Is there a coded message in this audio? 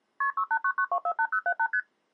Yes: multi-frequency trunk signalling (R1, as on North American trunks) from 0.2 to 1.8 s, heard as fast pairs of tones, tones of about 70 ms. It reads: KP 6899248078 ST